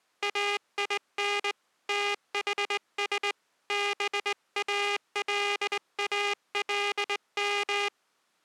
Morse code (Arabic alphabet), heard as a buzzer, hand-sent with a straight key, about 20 wpm. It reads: اين تحس بالالم